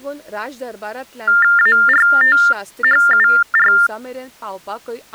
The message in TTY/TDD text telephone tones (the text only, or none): ARTHUR